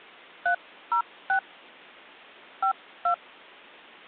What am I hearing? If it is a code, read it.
DTMF, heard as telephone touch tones, dialled by hand, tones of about 90 ms. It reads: 306 52